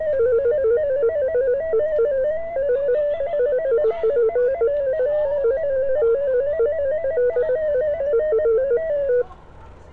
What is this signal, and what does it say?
Multi-tone FSK (Olivia or MFSK type), about 250 Hz wide, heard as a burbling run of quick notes, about 15.625 baud, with street noise.